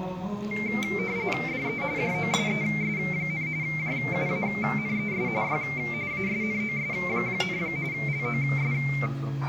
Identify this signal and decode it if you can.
RTTY (45.45 baud, 170 Hz shift), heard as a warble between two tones, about 2200 Hz centre, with the noise of a crowd indoors. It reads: DE JOSES, JUANES Y ASNOS, LOS